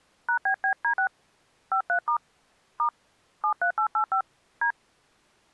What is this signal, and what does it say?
DTMF, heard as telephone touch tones, dialled by hand, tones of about 90 ms. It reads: #BBD6 53* * 73885 D